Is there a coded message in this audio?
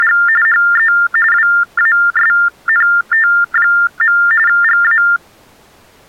Yes: TTY/TDD text telephone tones (45.45 baud Baudot) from 0.0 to 5.2 s, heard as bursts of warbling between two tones, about 400 Hz shift, 1600 Hz centre. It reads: … HE WASNT. GA